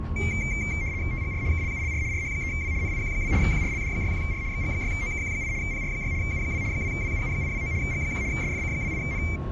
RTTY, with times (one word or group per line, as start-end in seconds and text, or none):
1.1-1.4 TGR
1.5-2.0 KLULR
2.1-2.7 RH3W
2.8-3.3 NIQ2
3.4-4.4 QRLD61R
4.5-5.5 XG6OKQ8
5.6-6.1 PR6
6.2-6.6 U2
6.7-7.7 2WUU829
7.8-8.2 G1
8.3-9.2 SFC28N